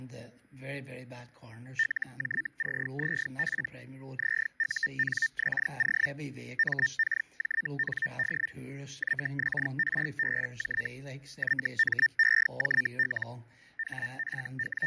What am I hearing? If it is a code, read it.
Hellschreiber (Feld-Hell, 122.5 baud), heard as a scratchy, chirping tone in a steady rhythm, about 1800 Hz, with fading. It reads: LJCZP ZUNXO MKJND YXRBJ YMEJL …